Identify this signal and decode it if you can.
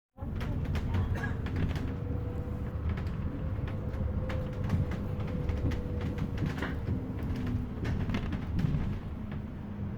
The noise inside a bus. There is no code.